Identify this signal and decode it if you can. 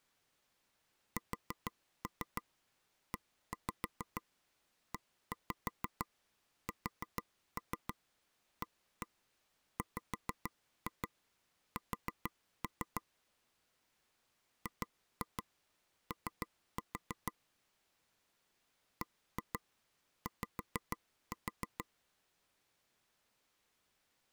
Tap code, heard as taps on a table, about 6 knocks a second. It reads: SEESAWS GO BY